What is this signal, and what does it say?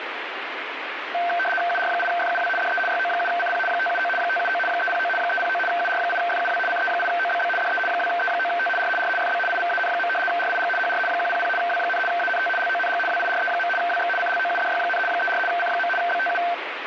RTTY (75 baud, 850 Hz shift), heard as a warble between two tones, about 1120 Hz centre, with radio static. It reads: UR8FUW DE YO7CP 579 579 309 309 UR8FUW CE8OBB DE 2E9T R R FB IVAN. RIG HR 100 W, ANT LONG WIRE. WX CLOUDY, 34 C. BTU